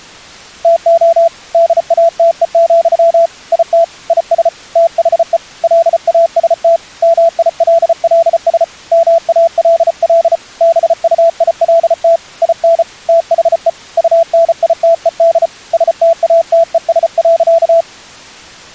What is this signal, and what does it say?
Morse code, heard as a keyed tone, hand-sent with a paddle, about 34 wpm, 670 Hz. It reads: TO DATE, IT IS THE LAST MILLS MALL BUILT IN THE UNITED STATES.